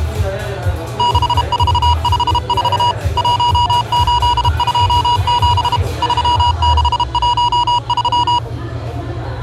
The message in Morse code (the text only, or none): 6454 1827 3613